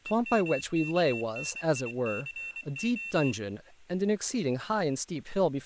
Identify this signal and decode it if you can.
Morse code (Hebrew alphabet), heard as a high beeper, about 24 wpm, 2700 Hz, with speech in English. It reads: ומכניסה